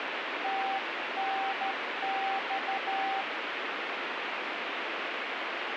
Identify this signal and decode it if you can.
Morse code, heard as a keyed tone, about 12 wpm, 780 Hz, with radio static. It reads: TNX